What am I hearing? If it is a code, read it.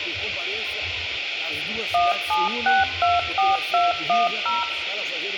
DTMF, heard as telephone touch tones, dialled by machine, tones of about 180 ms, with phone line noise. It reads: 17624210